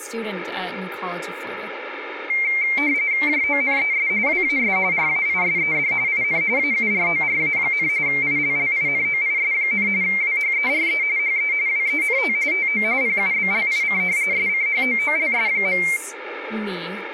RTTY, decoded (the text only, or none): JONES WAS RAISED IN AURORA, ILLINOIS, WHERE HE WENT TO PUBLIC SCHOOLS.